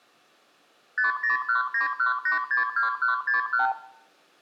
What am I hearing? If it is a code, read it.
Multi-frequency trunk signalling (R2, with the far end's replies), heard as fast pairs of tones, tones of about 130 ms, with room echo. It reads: 50191862161